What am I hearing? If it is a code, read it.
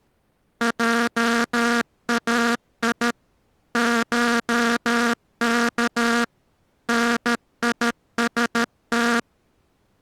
Morse code (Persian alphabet), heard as a buzzer, machine-sent, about 13 wpm. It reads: جای شک نیست